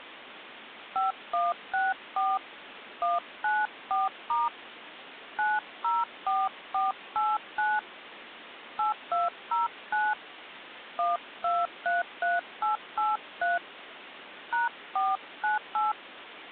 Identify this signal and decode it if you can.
DTMF, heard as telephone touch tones, dialled by hand, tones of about 170 ms, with phone line noise. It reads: 5164 194* 904489 8209 1233883 #498